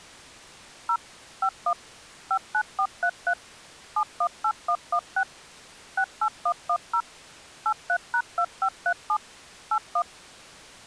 DTMF, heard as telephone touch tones, dialled by machine, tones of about 70 ms. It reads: 0 51 59433 718116 68110 83#2537 81